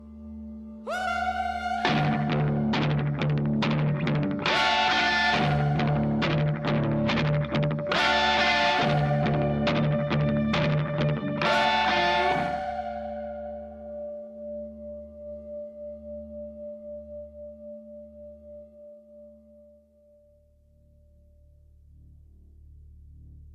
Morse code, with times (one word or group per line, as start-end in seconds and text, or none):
none